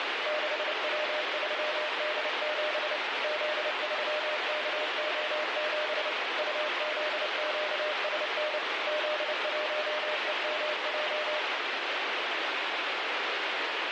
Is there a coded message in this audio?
Yes: Morse code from 0.2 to 11.5 s, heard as a keyed tone, machine-sent, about 29 wpm, 610 Hz, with heavy radio static. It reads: 6W3D7 Z3KO7 UZQSN Z1EMJ